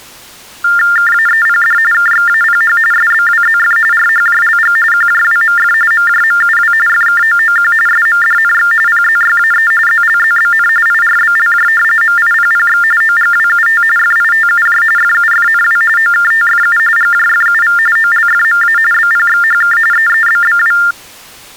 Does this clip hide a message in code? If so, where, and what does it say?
Yes: TTY/TDD text telephone tones (45.45 baud Baudot) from 0.6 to 20.9 s, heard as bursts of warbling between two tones, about 400 Hz shift, 1600 Hz centre. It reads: KAEPD KXAPH SBWZF RHJLG QJWMF MJMUW FKOOQ SMDNX PZYAE ZLZBN IRBLJ MIPPX OGWUT FITUJ FUFNW OKTFU GJFUV OLFMA BPXHK EEBBW